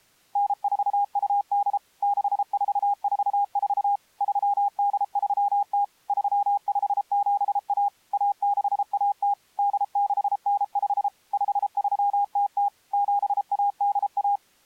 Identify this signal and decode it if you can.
Morse code (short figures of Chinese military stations), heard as a keyed tone, machine-sent, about 33 wpm, 810 Hz. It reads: 9428 6444 3830 3571 1610 8695 5300 7181